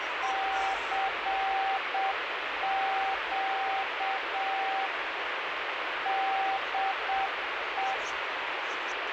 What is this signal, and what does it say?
Morse code, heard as a keyed tone, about 7 wpm, 780 Hz, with heavy radio static and the noise of a park. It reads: CQ DE